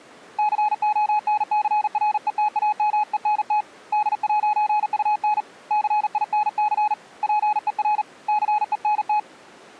Morse code, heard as a keyed tone, hand-sent with a paddle, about 39 wpm, 840 Hz. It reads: CONCRETAMENT D'UN CINC PER CENT